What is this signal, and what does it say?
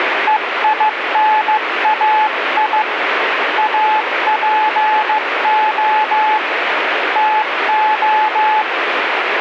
Morse code (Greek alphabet), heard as a keyed tone, hand-sent with a paddle, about 15 wpm, 860 Hz, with heavy radio static. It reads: ΕΙΝΑΙ ΑΠΟ ΤΟ